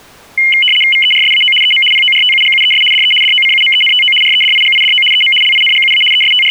RTTY (75 baud, 850 Hz shift), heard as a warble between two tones, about 2550 Hz centre. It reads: VERSAO EM PORTUGUES DE DOCUMENTO REDIGIDO EM LINGUA …